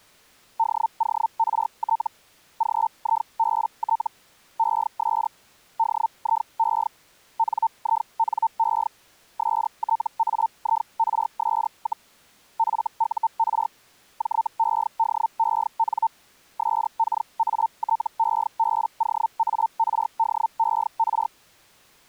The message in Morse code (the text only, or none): none